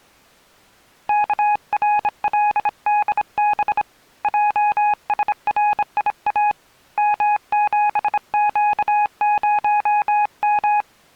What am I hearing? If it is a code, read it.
Morse code, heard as a keyed tone, hand-sent with a bug key, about 26 wpm, 830 Hz. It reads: KRLDB JSRIA M7Q0M